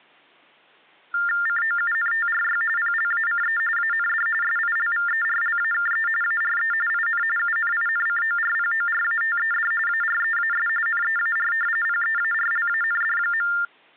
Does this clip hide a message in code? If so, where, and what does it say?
Yes: TTY/TDD text telephone tones (45.45 baud Baudot) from 1.1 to 13.7 s, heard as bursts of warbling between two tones, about 400 Hz shift, 1600 Hz centre. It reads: COUNTRY PLACE AND SILVERLAKE ARE IN UNINCORPORATED AREAS NEAR PEARLAND.